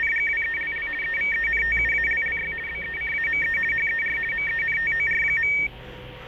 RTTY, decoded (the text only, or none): … EVENTUALLY BECAME HER MENTOR.